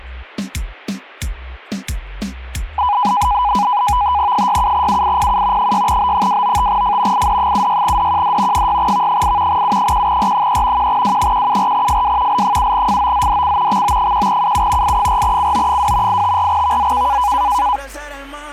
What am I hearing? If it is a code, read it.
NAVTEX (SITOR-B), 100 baud, 170 Hz shift, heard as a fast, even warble, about 910 Hz centre. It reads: 67UIPU 6B295F ID76DQD 6V8 U1R3 1W174FW L7FOZDC XO1UU I4CO2 854VZK